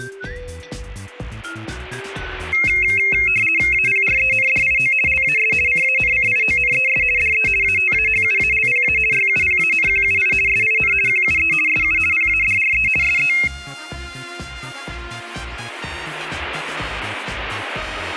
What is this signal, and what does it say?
RTTY (50 baud, 450 Hz shift), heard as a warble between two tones, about 2350 Hz centre, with static crashes. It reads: APRENDIO LAS CANCIONES DE ATAHUALPA YUPANQUI SIN QUE SU PADRE SE